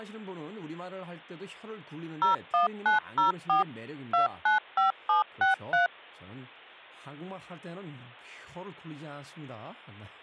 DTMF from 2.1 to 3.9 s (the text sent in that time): 01904